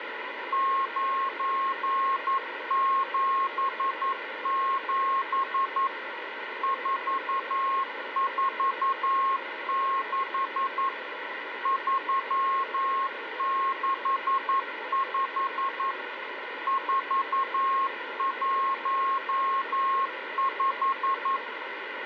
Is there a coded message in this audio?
Yes: Morse code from 0.5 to 21.4 s, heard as a keyed tone, machine-sent, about 11 wpm, 1080 Hz, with radio static. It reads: 977 446 365 415